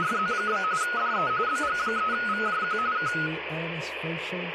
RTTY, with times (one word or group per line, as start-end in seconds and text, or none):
0.0-0.6 …
0.8-1.3 DE
1.5-2.8 BG3VJQ
3.0-3.1 K